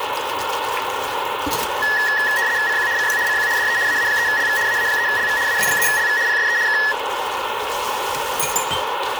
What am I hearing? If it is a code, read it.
RTTY (75 baud, 170 Hz shift), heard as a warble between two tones, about 1800 Hz centre, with radio static and kitchen noise. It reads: CQ CQ CQ DE AA3LV AA3LV AA3LV PSE K